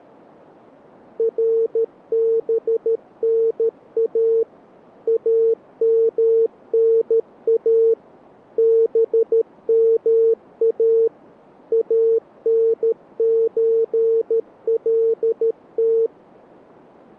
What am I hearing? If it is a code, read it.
Morse code (Arabic alphabet), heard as a keyed tone, machine-sent, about 13 wpm, 450 Hz. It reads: ربنا امنا بما انزلت